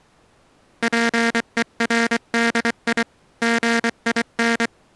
Morse code, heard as a buzzer, hand-sent with a paddle, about 24 wpm. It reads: PERDI GIN